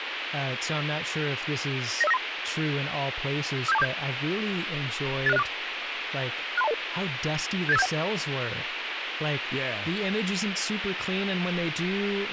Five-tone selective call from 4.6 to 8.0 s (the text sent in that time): 86064 63200 78571